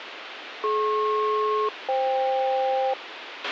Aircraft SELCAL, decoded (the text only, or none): DP-FK